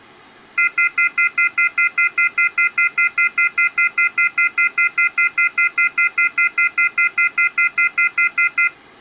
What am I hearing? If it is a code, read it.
Telephone call progress tone (North American plan), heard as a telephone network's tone, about 1400, 2050, 2450, 2600 Hz, 0.1 s on and 0.1 s off. Off-hook warning tone.